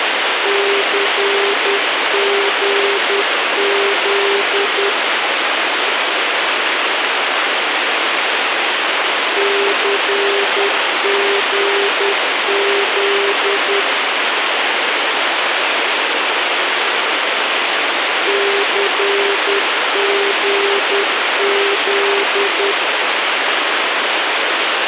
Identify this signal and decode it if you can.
Morse code, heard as a keyed tone, machine-sent, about 10 wpm, 400 Hz, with radio hiss. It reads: CGZ CGZ CGZ